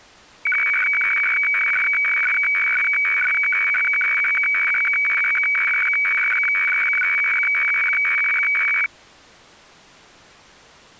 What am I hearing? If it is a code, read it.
Weather fax (radiofax), 120 lines a minute, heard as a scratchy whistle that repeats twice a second.